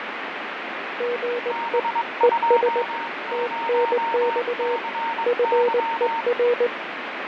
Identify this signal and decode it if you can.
Morse code, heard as two keyed tones, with heavy radio static and fading. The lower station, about 19 wpm, 480 Hz: GE ES TNX FER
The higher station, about 22 wpm, 920 Hz: B20CY